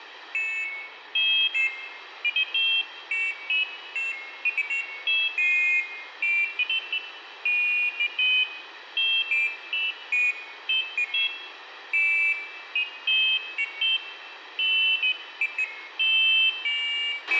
Pairs of high tones at irregular times, with radio hiss, a squelch burst at the end and room echo. There is no code.